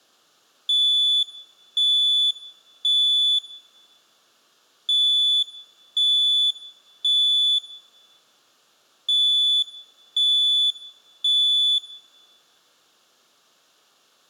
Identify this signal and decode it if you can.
Alarm pattern, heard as an alarm's beeps, played three times, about 3450 Hz, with room echo. Temporal three. Smoke or fire, evacuate.